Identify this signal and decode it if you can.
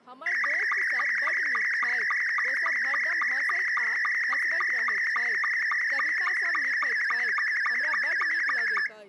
SSTV (slow-scan television), Scottie S2, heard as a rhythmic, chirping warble, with speech in Maithili.